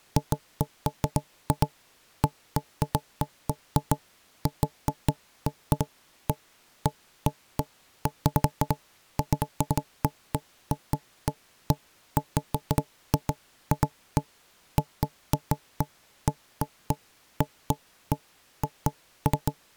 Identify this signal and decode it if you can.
Irregular knocks on wood. There is no code.